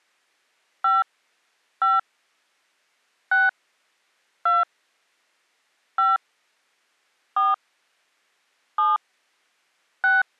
DTMF, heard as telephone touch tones, dialled by hand, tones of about 180 ms. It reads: 5 5 6 2 5 4 7 6